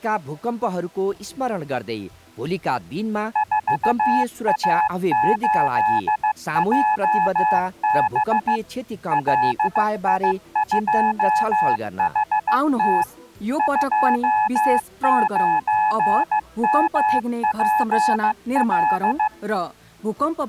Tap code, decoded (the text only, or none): none